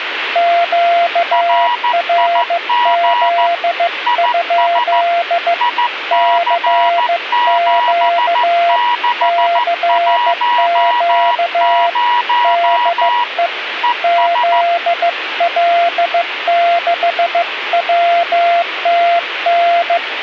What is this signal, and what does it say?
Morse code, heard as two keyed tones, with radio static. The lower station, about 15 wpm, 690 Hz: QRZ? CQ CQ DE ZL6WTN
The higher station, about 14 wpm, 970 Hz: RIG IS IC7610 ES